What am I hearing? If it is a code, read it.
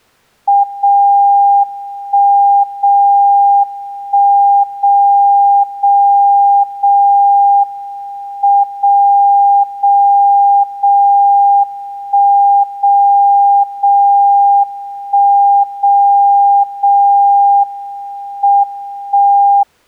Radio time signal (WWVB), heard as a tone whose level steps once a second, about 800 Hz. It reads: 0 1 0 1 0 0 0 M 0 0 0 1 0 0 1 0 0 M 1